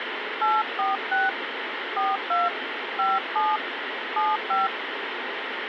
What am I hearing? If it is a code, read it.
DTMF, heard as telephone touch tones, dialled by hand, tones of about 180 ms, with radio hiss. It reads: 846 42 57 75